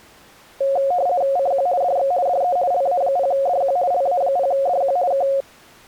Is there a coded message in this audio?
Yes: RTTY (50 baud, 170 Hz shift) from 0.6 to 5.4 s, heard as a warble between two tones, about 630 Hz centre. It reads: CQ DX DE LA0DQ LA0DQ K